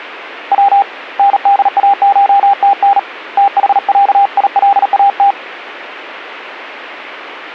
Morse code (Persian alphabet), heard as a keyed tone, hand-sent with a paddle, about 38 wpm, 800 Hz. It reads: و نداشتن تحصیلات